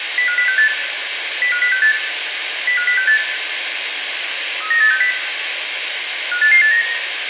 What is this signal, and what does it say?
Five-tone selective call (CCIR), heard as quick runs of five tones, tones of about 100 ms, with radio hiss and room echo. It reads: 05068 05068 05068 39860 58889